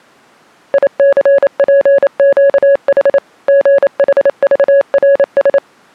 Morse code, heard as a keyed tone, machine-sent, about 28 wpm, 560 Hz. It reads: ICPQH GHVRS